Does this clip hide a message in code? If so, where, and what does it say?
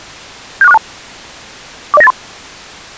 Yes: five-tone selective call (EIA) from 0.6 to 2.1 s, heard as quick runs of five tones, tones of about 30 ms. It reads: 76462 40983